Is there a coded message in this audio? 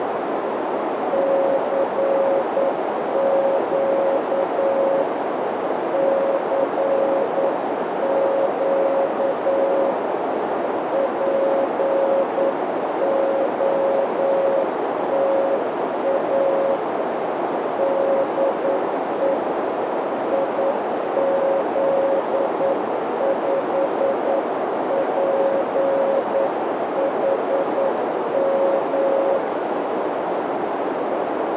Yes: Morse code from 1.1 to 29.4 s, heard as a keyed tone, hand-sent with a paddle, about 9 wpm, 550 Hz, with heavy radio static and a narrow filter. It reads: CQ CQ POTA DE IZ5PHM